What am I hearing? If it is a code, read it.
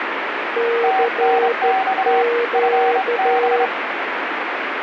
Morse code, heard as two keyed tones, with heavy radio static. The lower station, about 13 wpm, 470 Hz: CQ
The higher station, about 27 wpm, 760 Hz: TNX FB